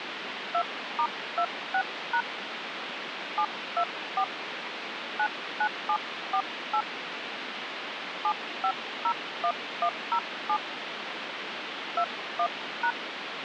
DTMF, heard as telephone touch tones, dialled by hand, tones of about 70 ms, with phone line noise. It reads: 2*26# 724 99748 7501107 21#